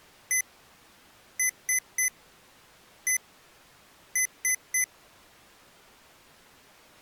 Beep code, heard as beeps from a small speaker, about 2000 Hz. 1-3-1-3. In Phoenix BIOS tables: keyboard controller test failure.